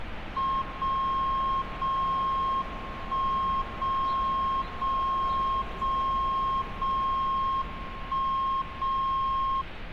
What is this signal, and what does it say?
Radio time signal (WWVB), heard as a tone whose level steps once a second, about 1070 Hz, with street noise. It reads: 0 0 1 0 0 0 0 1 0